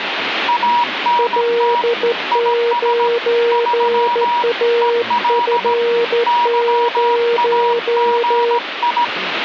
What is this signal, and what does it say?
Morse code, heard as two keyed tones, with radio static and speech in Finnish. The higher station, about 17 wpm, 960 Hz: ANT IS 3 EL YAGI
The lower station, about 14 wpm, 470 Hz: L9AF0